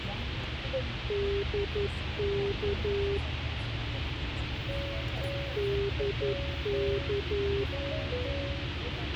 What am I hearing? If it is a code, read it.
Morse code, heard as a keyed tone, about 11 wpm, 400 Hz, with radio hiss, a squelch burst at the end and the noise inside a car. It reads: DK DK